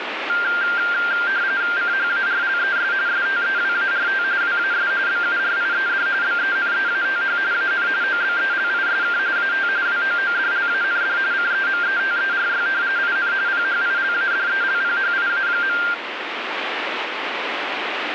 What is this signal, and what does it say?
RTTY (45.45 baud, 170 Hz shift), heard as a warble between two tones, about 1490 Hz centre, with radio static. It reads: CHARLES STEWART WAS BURIED BENEATH AN OBELISK AT WOODLAND CEMETERY IN PHILADELPHIA.